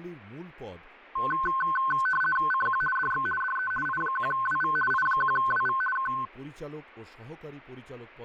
RTTY (50 baud, 450 Hz shift), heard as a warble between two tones, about 1290 Hz centre, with speech in Bangla. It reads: CQ DX DE I1WV I1WV K